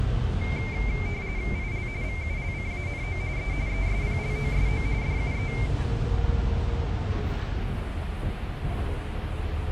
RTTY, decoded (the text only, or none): IL VULCANO E ESPLOSO DUE